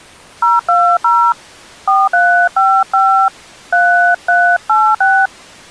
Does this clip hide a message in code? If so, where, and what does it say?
Yes: DTMF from 0.4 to 5.3 s, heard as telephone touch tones, dialled by hand, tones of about 300 ms. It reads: 020 4355 3386